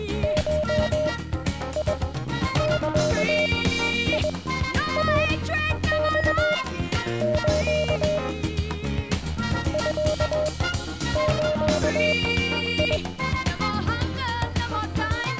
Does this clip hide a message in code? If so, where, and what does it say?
Yes: Morse code (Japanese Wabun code) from 0.2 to 13.0 s, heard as a keyed tone, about 21 wpm, spaced as for 10 wpm, 610 Hz. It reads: ゴザイマス ミズ